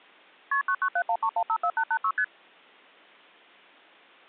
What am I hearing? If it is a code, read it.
Multi-frequency trunk signalling (R1, as on North American trunks), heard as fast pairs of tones, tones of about 70 ms. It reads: KP 99713154886 ST